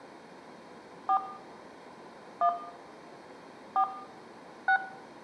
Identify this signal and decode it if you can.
DTMF, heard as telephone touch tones, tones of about 80 ms, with room echo. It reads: 4 1 4 6